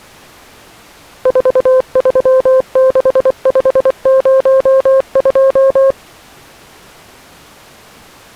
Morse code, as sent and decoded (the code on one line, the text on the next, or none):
....- ...-- -.... ..... ----- ..---
436502